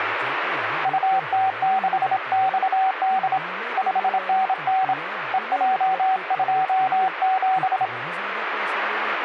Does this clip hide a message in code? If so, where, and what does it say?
Yes: Morse code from 0.8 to 7.9 s, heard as a keyed tone, hand-sent with a straight key, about 27 wpm, 760 Hz, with radio static and speech in Hindi. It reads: UT6XD 5NN EJ27